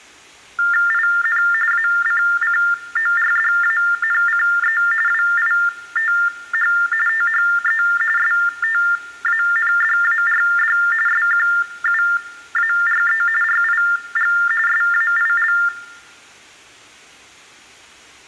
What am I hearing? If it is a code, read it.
TTY/TDD text telephone tones (45.45 baud Baudot), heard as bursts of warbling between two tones, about 400 Hz shift, 1600 Hz centre, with room echo. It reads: IN ACCORDANCE WITH THE STANDARD SQUARE RIG SAIL